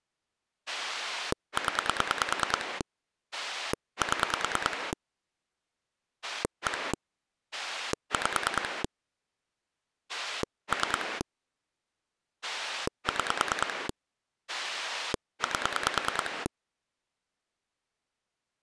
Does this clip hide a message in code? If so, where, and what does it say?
Yes: pulse dialling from 0.7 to 16.5 s, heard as a rotary dial, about 9 pulses a second. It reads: 0 7 1 5 3 6 8